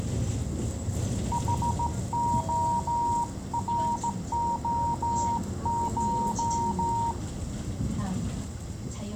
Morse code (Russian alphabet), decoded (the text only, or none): ХОРОШ